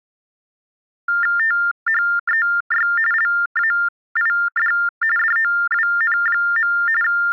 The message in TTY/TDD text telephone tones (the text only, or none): THEY LAID DOWN. …